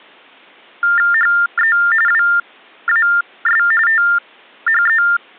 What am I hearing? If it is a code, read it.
TTY/TDD text telephone tones (45.45 baud Baudot), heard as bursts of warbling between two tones, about 400 Hz shift, 1600 Hz centre. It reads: HE WAS THE